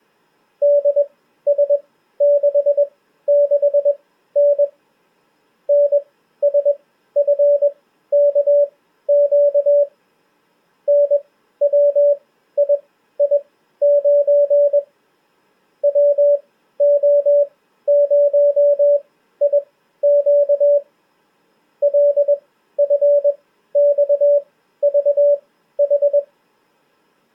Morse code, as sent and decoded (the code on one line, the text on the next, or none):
-.. ... -.... -.... -. / -. ... ..-. -.- --.- / -. .-- .. .. ----. / .-- --- ----- .. --.- / .-.. ..-. -..- ...- ....
DS66N NSFKQ NWII9 WO0IQ LFXVH